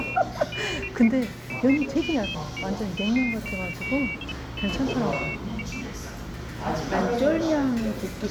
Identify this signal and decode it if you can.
Pairs of high tones at irregular times, with the noise of a crowd indoors. There is no code.